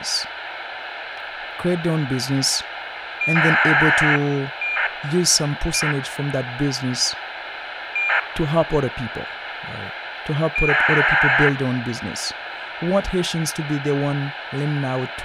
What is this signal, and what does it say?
ACARS aircraft data, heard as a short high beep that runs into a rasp, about 2400 baud, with radio hiss and speech in English.